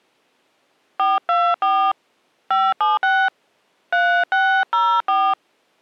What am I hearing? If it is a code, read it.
DTMF, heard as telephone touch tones, dialled by hand, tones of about 230 ms. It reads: 424 576 3604